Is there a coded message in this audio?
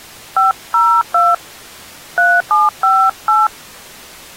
Yes: DTMF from 0.4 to 3.5 s, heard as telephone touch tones, dialled by hand, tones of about 200 ms. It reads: 502 3758